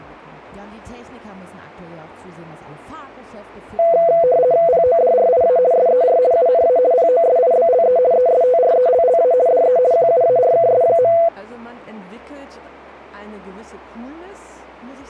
RTTY (50 baud, 170 Hz shift), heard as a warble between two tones, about 590 Hz centre. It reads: PODRIA SER UNA POSIBLE ESTRELLA DE QUARKS.